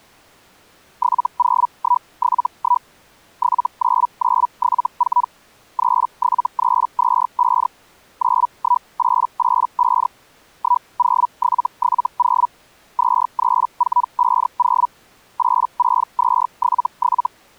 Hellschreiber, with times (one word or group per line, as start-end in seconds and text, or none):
1.0-2.9 70171
3.4-5.3 79974
5.8-7.7 37325
8.2-10.1 91885
10.6-12.5 10770
13.0-14.9 23450
15.4-17.3 86277